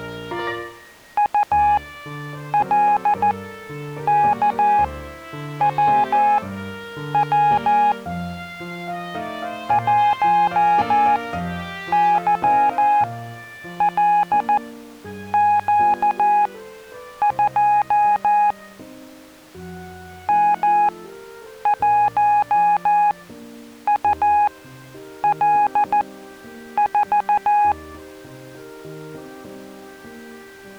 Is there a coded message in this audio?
Yes: Morse code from 1.1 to 27.8 s, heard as a keyed tone, machine-sent, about 14 wpm, spaced as for 8 wpm, 830 Hz. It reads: ULKWW 1YLQ2 M1UL4